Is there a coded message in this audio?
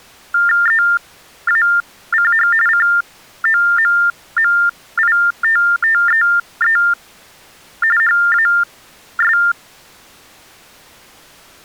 Yes: TTY/TDD text telephone tones (45.45 baud Baudot) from 0.3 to 9.5 s, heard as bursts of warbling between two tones, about 400 Hz shift, 1600 Hz centre. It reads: EACH COMMITTEE HAS